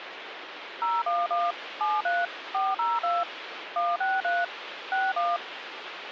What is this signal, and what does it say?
DTMF, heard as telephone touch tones, dialled by machine, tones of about 200 ms, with phone line noise. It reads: 011 73 402 163 61